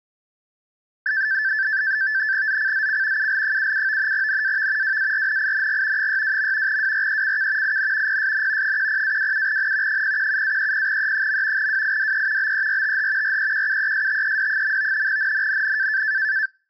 NAVTEX (SITOR-B), 100 baud, 170 Hz shift, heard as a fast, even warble, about 1650 Hz centre. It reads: ZCZC UL77 NAV WARNING 62. WRECK IN PSN 10-27N 017-30E. WIDE BERTH REQUESTED. NNNN